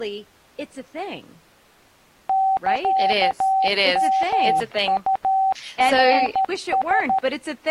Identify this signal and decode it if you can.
Morse code (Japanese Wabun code), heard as a keyed tone, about 13 wpm, 770 Hz, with speech in English. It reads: サヨウナラ